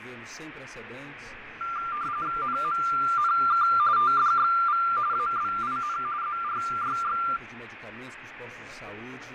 RTTY (45.45 baud, 170 Hz shift), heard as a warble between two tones, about 1280 Hz centre, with radio static and fading. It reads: NMNK TDXV ABIN ZRYX